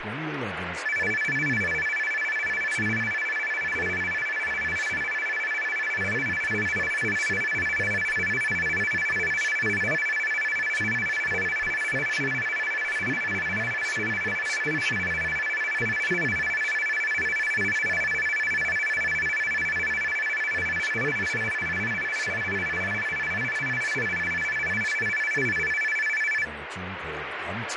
A tone that alternates evenly between two pitches, with radio static and speech in English. There is no code.